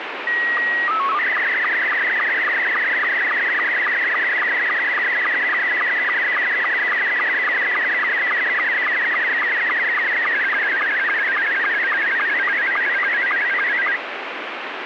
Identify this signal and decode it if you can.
SSTV (slow-scan television), Scottie S2, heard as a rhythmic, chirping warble, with radio static.